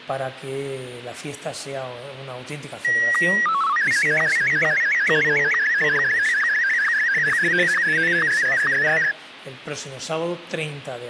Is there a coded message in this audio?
Yes: SSTV (slow-scan television), Martin M1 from 2.8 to 9.1 s, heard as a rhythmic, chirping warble.